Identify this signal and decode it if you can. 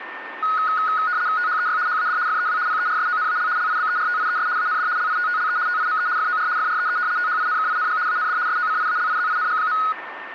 RTTY (75 baud, 170 Hz shift), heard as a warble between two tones, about 1360 Hz centre, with radio static and a steady whistle near 1810 Hz. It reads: THEY HAD FEW PERSONAL LIBERTIES AND LITTLE TIME FOR FREE THINKING AND SOCIALIZING.